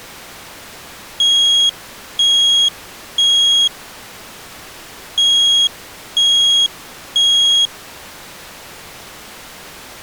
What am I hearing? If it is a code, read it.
Alarm pattern, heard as an alarm's beeps, played twice, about 3300 Hz. Temporal three. Smoke or fire, evacuate.